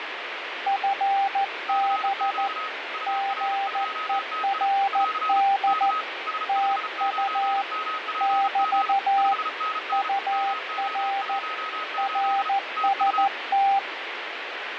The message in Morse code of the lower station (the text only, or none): FB GERD TU <BT> UR RST